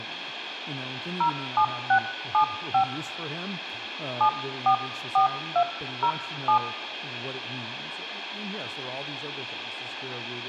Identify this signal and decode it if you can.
DTMF, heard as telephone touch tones, dialled by hand, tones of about 90 ms, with radio hiss, room echo and speech in English. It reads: 07675 744207